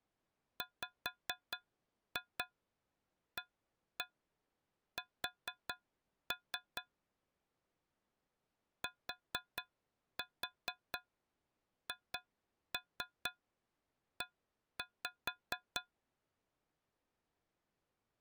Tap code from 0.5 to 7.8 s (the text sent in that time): WAS